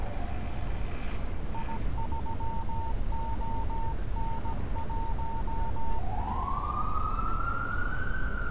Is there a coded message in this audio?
Yes: Morse code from 1.5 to 6.0 s, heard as a keyed tone, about 17 wpm, 910 Hz, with street noise. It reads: I3ON1